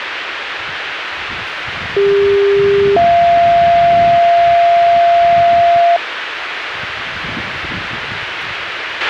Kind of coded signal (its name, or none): two-tone page